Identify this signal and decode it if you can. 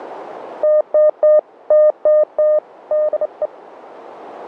Morse code, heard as a keyed tone, hand-sent with a straight key, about 28 wpm, 610 Hz, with radio static. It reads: TTT TTT DE